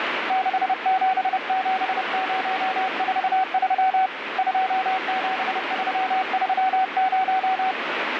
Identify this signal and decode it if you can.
Morse code, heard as a keyed tone, hand-sent with a paddle, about 30 wpm, 760 Hz, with radio static. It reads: 677043 27330